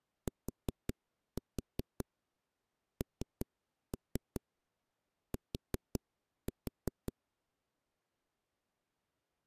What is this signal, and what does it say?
Tap code, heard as knocks on a wall, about 5 knocks a second. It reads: TNT